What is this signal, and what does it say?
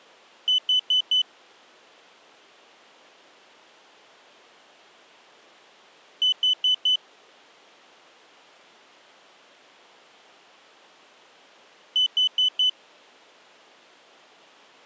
Alarm pattern, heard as an alarm's beeps, played three times, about 3000 Hz. Temporal four. Carbon monoxide.